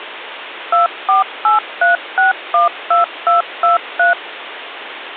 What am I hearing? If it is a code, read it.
DTMF, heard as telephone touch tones, dialled by machine, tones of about 140 ms, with phone line noise. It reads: 2483612223